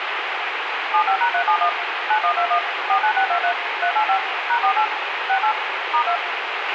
DTMF, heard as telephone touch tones, dialled by machine, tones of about 90 ms, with radio hiss and a squelch burst at the end. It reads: 75#371 9121 49623 385 #48 68 *2